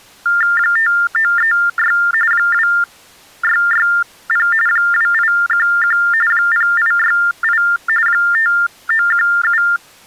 TTY/TDD text telephone tones (45.45 baud Baudot), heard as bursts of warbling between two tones, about 400 Hz shift, 1600 Hz centre. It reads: 5936 2660 2811 0868 5917